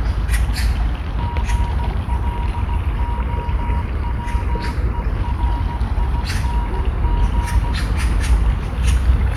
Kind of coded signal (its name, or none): Morse code